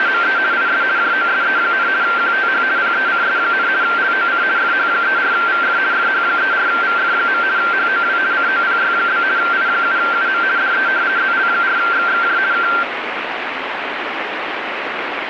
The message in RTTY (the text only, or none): … IS JOSE, QTH PECS, LOC FH34VF FH34VF. HOW COPY? I7UM DE ZL4XXJ K